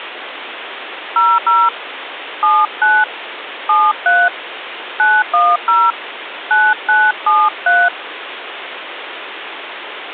DTMF, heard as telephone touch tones, dialled by hand, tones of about 220 ms, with phone line noise. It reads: 00 79 73 910 9973